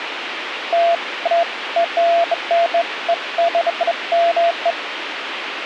Beeps of irregular length, with radio hiss. There is no code.